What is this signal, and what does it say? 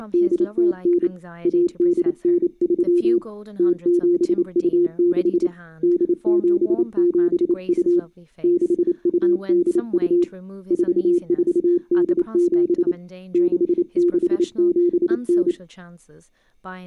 Morse code (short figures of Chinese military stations), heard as a keyed tone, hand-sent with a paddle, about 28 wpm, 350 Hz, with speech in English. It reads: … 1893 0726 8772 6282 4487 6679